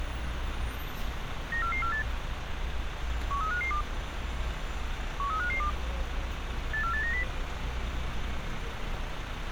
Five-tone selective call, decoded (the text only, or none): 94448 13552 13552 84890